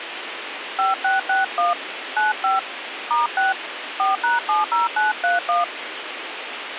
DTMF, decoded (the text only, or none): 5661 95 *6 4#70931